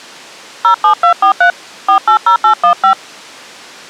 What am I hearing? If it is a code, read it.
DTMF, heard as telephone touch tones, dialled by hand, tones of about 100 ms. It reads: 07243 480815